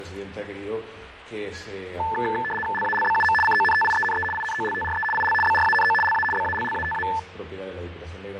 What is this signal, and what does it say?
RTTY (75 baud, 850 Hz shift), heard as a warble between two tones, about 1320 Hz centre, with radio static and fading. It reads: LALBUM CONTIENE INOLTRE IL BRANO LA BALLATA